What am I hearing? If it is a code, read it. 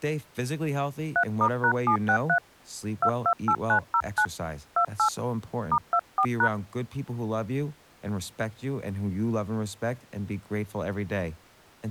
DTMF, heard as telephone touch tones, dialled by hand, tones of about 80 ms, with speech in English. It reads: 3*#763 228909 28 *24#